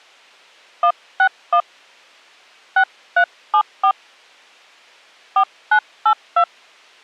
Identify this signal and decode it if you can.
DTMF, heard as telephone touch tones, dialled by hand, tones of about 80 ms. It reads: 161 6374 4982